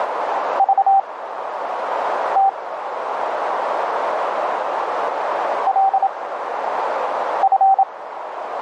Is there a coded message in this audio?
Yes: Morse code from 0.5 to 7.9 s, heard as a keyed tone, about 27 wpm, spaced as for 6 wpm, 780 Hz, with radio static and a narrow filter. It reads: VT LF